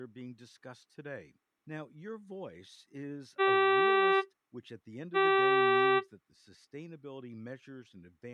Ship horn signal, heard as a ship's horn, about 390 Hz, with speech in English. 2 short. At sea: I am altering course to port.